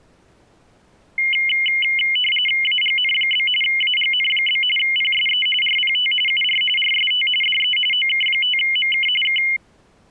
RTTY (45.45 baud, 850 Hz shift), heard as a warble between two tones, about 2550 Hz centre. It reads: AGN? AGN? PSE RPT UR RST DE OK5MK K